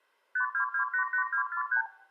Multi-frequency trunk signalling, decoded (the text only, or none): 52288243